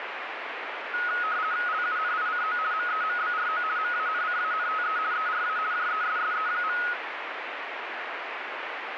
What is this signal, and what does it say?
RTTY (50 baud, 170 Hz shift), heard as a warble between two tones, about 1360 Hz centre, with radio static. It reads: LUNICO MEMBRO MANCANTE ERA JESSE.